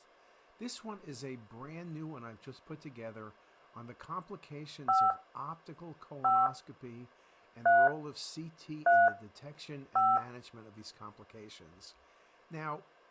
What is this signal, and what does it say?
DTMF, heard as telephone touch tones, dialled by hand, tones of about 220 ms, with speech in English. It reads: 5 5 3 3 5